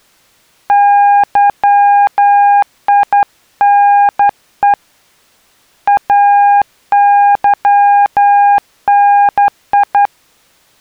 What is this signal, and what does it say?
Morse code, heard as a keyed tone, hand-sent with a straight key, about 11 wpm, 810 Hz. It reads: YINE AYNI